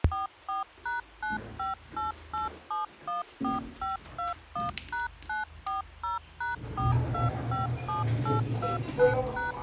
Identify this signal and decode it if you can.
DTMF, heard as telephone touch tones, dialled by machine, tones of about 150 ms, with the noise inside a lift. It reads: 44#9588714521#940#4257829#